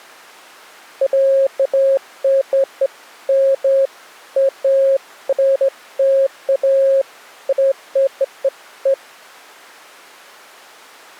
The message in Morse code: none

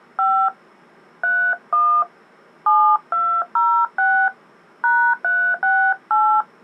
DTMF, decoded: 5 31 7206 #368

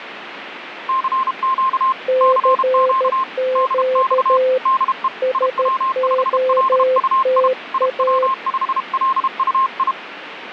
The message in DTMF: none

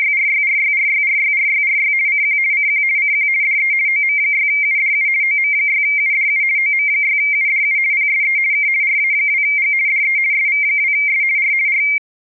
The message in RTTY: … CQ CQ CQ DE OM6UDU OM6UDU OM6UDU PSE K RA2G DE SV2S R R

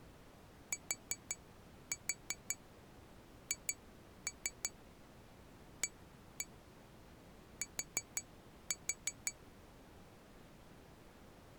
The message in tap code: THAT

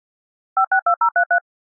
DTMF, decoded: 562033

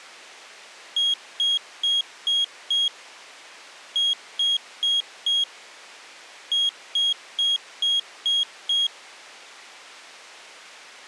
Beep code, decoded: 5-4-6

